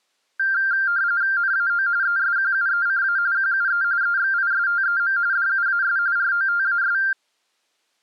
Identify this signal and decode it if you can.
RTTY (45.45 baud, 170 Hz shift), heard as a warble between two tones, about 1480 Hz centre. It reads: NAO ESQUECA QUE EXISTEM DUAS ROTAS